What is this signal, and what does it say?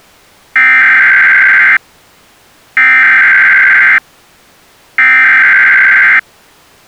Emergency Alert System (SAME) tones (header bursts), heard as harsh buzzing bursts, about 520.83 baud.